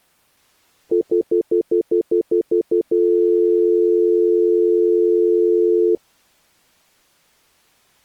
Telephone call progress tone (North American plan), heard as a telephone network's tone, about 350, 440 Hz, 0.1 s on and 0.1 s off. Stutter dial tone.